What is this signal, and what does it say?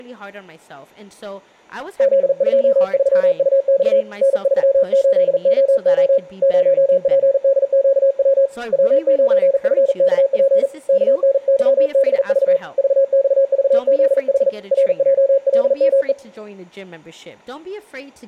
Morse code, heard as a keyed tone, hand-sent with a paddle, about 40 wpm, 540 Hz, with speech in English. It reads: Z23UX N38OO 0PDQW W9FKP KNYBV VXVZH RJLME